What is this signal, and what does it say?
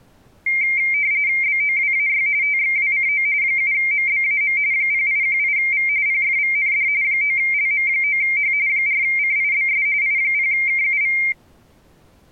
RTTY (45.45 baud, 170 Hz shift), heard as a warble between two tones, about 2200 Hz centre. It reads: BOWAY TXWCO 7MBAM 0818V PFVND 9LM9H 4CIBS I0KUV